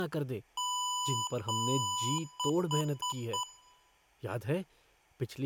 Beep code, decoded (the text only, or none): 2 long, 4 short